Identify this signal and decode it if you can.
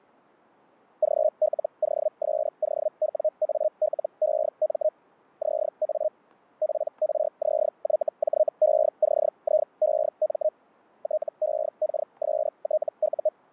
Hellschreiber (Feld-Hell, 122.5 baud), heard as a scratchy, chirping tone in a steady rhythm, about 620 Hz, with static crashes. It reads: GLOSOWALEM ZA PRZYJECIEM TEKSTU